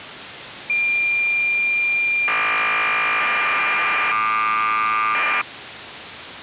Cassette data (Kansas City type), 1200 baud, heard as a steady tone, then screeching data.